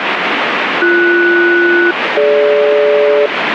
Aircraft SELCAL, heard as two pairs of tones, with radio static. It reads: BS-DG